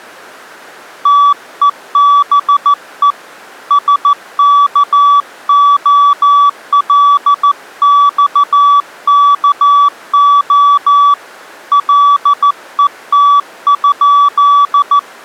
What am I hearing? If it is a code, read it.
Morse code (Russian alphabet), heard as a keyed tone, hand-sent with a paddle, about 14 wpm, 1150 Hz. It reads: ТЕБЕ СКОЛЬКО ЛЕТ?